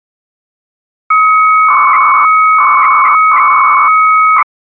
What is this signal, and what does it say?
300-baud modem data (Bell 103 tones), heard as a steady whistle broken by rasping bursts, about 300 baud, 200 Hz shift.